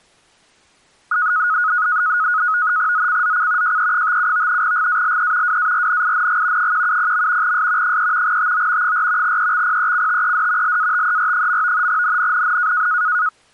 NAVTEX (SITOR-B), 100 baud, 170 Hz shift, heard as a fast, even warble, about 1360 Hz centre. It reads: ZCZC JE57 GALE WARNING 170. S 3 TO 4 EXPECTED LATER. NNNN